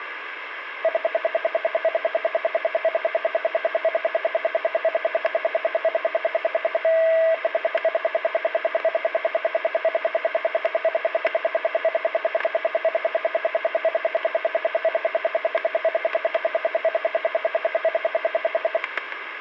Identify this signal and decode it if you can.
Radio time signal (RWM, Moscow), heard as ten pulses a second, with static crashes.